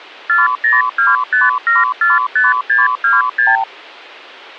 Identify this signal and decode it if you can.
Multi-frequency trunk signalling (R2, with the far end's replies), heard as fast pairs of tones, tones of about 170 ms. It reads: 4025745626